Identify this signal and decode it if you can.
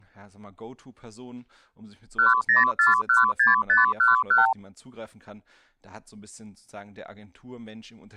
Multi-frequency trunk signalling (R2, with the far end's replies), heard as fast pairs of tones, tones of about 150 ms, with speech in German. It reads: 10416511